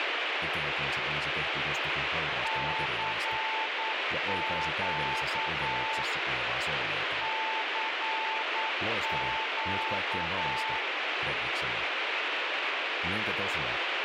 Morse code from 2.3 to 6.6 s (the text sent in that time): CQ